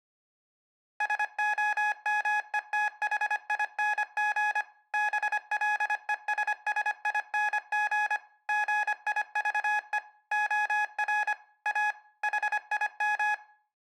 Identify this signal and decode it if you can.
Morse code, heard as electronic beeps, machine-sent, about 25 wpm, 840 Hz, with room echo. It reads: SOMETHING BLESSING GIVE OR A HIM